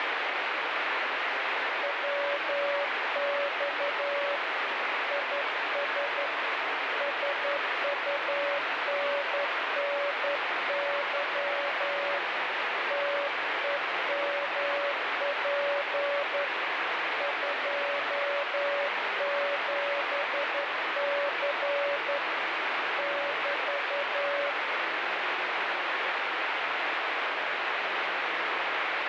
Morse code, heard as a keyed tone, hand-sent with a straight key, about 11 wpm, 570 Hz, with heavy radio static. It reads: WX IS SUNNY TEMP 27C <BT>